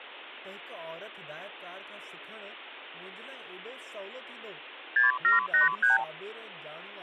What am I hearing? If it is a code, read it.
Multi-frequency trunk signalling (R2, with the far end's replies), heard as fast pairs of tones, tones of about 140 ms, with speech in Sindhi. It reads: 6783